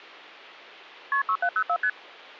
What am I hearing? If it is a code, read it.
Multi-frequency trunk signalling (R1, as on North American trunks), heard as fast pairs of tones, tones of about 70 ms. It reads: KP 6704 ST